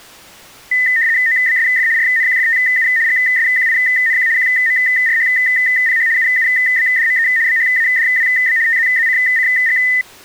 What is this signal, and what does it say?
RTTY (75 baud, 170 Hz shift), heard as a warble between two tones, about 1900 Hz centre. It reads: OBSF RNQFTU GSQINQ QMRHPH UUBDME BHADWB TZZCCG